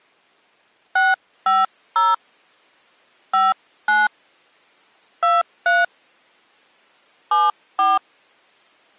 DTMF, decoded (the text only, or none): 650 59 23 74